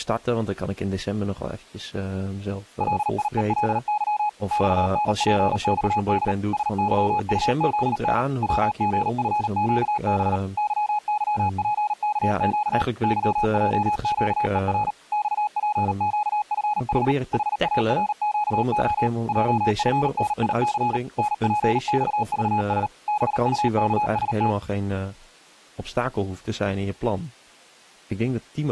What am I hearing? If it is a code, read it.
Morse code, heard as a keyed tone, machine-sent, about 38 wpm, 840 Hz, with speech in Dutch. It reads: LIELY XNPXD SYUZN WGFQB YYPKQ YJQER XPQFH HARQO JFNIC NPXVS BUKST